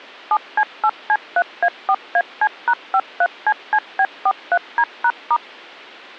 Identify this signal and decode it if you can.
DTMF, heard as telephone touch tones, dialled by machine, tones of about 60 ms. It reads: 7C8C3A4AC#53CCB43D#*